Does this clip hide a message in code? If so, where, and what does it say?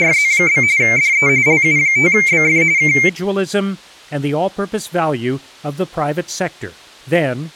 Yes: RTTY (45.45 baud, 170 Hz shift) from 0.0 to 3.1 s, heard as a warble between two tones, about 2200 Hz centre, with speech in English. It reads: … DE LU5BF K